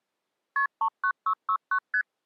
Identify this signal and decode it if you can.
Multi-frequency trunk signalling (R1, as on North American trunks), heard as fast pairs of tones, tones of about 80 ms. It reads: KP 39669 ST